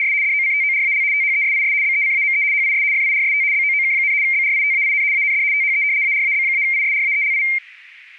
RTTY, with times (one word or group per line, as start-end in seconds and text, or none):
0.0-0.1 …
0.2-1.0 DOCTORAL
1.1-1.7 THESIS
1.8-2.4 BECAME
2.5-2.8 HIS
2.9-3.4 FIRST
3.5-4.1 BOOK,
4.2-5.0 BRITAIN
5.1-5.4 AND
5.5-5.8 THE
6.0-7.4 ARAB-ISRAELI